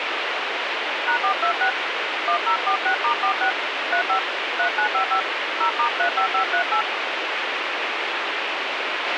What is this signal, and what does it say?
DTMF, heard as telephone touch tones, dialled by hand, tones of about 100 ms, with radio hiss and a squelch burst at the end. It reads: #426 1046*46 35 3955 0*35538